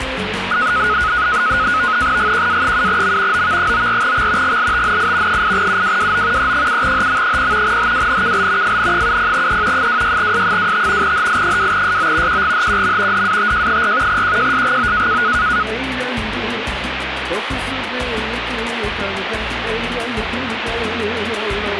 NAVTEX (SITOR-B), 100 baud, 170 Hz shift, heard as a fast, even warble, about 1360 Hz centre, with radio static. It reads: GQA7M OV94X GLTNI 8UWWO E7HM0 HWNKL FN70E 26S25 HI2SO QGHQM DATJ4 QJSGO